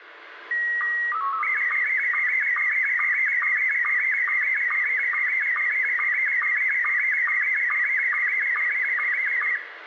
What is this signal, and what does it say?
SSTV (slow-scan television), Scottie S1, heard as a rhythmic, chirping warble, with radio static and room echo.